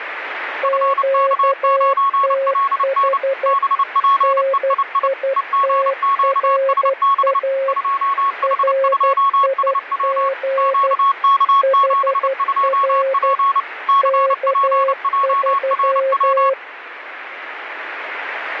Morse code, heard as two keyed tones, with radio static. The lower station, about 12 wpm, 540 Hz: QTH NITRA RIG HR K3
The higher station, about 29 wpm, 1100 Hz: FK9LN BPEII EGQSB 2H2SW QK72P CPJRW